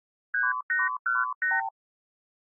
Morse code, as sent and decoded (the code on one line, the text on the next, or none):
none